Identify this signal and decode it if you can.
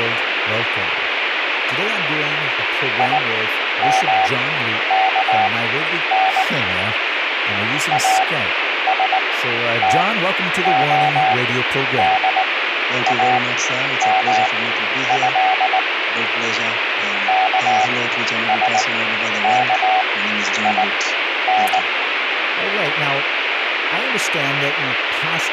Morse code (Arabic alphabet), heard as a keyed tone, machine-sent, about 19 wpm, spaced as for 10 wpm, 760 Hz, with radio static and speech in English. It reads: يمكن استخدامه كسكين